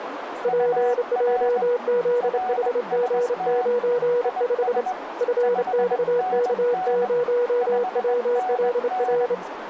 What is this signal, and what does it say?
Morse code, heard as two keyed tones, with radio static, a narrow filter and speech in English. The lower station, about 28 wpm, 480 Hz: PJZHG95 FXK0WLR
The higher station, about 20 wpm, 740 Hz: UR RST IS 5NN 5NN